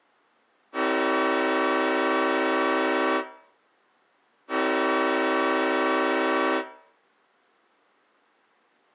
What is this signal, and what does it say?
Train horn signal, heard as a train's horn, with room echo. 2 long. On North American railways: brakes released, proceed.